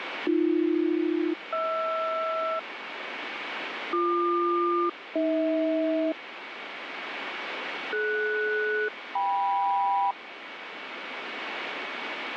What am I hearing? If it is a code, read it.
Aircraft SELCAL, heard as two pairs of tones, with radio static. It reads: AB-HR BQ-AH DS-KM